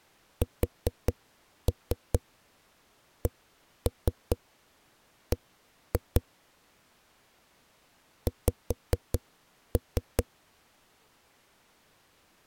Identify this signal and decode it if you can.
Tap code, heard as knocks on a wall, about 4 knocks a second. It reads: SCB X